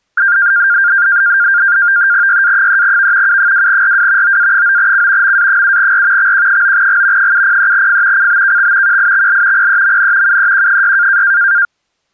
NAVTEX (SITOR-B), 100 baud, 170 Hz shift, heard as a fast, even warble, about 1500 Hz centre. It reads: YA3V U2RW OA9C MA7R XQ9G 703F CBKX QIXL PEMN UEQ6